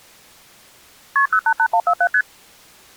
Multi-frequency trunk signalling (R1, as on North American trunks), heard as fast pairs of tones, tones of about 70 ms. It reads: KP 088147 ST